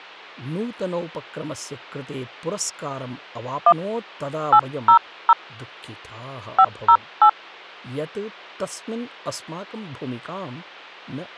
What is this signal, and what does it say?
DTMF, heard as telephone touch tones, dialled by hand, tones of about 70 ms, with speech in Sanskrit. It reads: 1 800 508